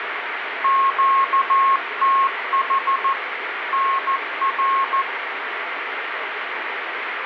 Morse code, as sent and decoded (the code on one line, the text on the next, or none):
--.- - .... / -. .-.
QTH NR